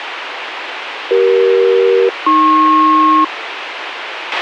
Aircraft SELCAL, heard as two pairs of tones, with radio hiss and a squelch burst at the end. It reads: CE-AP